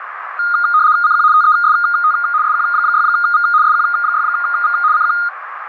RTTY (75 baud, 170 Hz shift), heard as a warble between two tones, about 1330 Hz centre, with radio static and a narrow filter. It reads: CQ TEST SQ6V SQ6V CQ